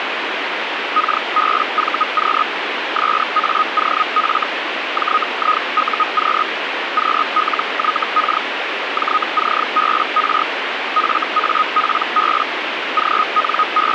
Hellschreiber (Feld-Hell, 122.5 baud), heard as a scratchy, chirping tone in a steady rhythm, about 1250 Hz, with radio static. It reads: KBVQ SAOF JIUQ QLYK JCBR FAPB …